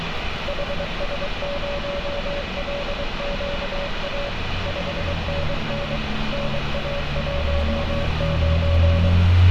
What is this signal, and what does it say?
Morse code, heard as a keyed tone, machine-sent, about 23 wpm, 570 Hz, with heavy radio static and street noise. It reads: HS0LQA 5NN NA19